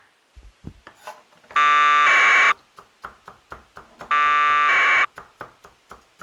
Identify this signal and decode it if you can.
Packet radio (AX.25, as in APRS), 1200 baud, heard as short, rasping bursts, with kitchen noise.